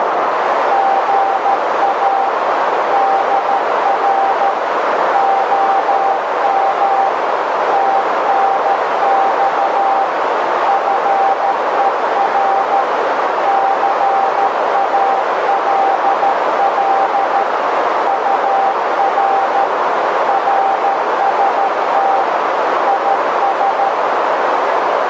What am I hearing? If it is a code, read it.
Morse code, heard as a keyed tone, machine-sent, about 13 wpm, 780 Hz, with heavy radio static and a narrow filter. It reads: GA DR OM TNX FER CALL UR RST IS